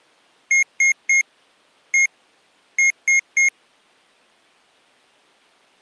Beep code, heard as beeps from a small speaker, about 2150 Hz. 3-1-3. In Phoenix BIOS tables: interrupt mask register failure.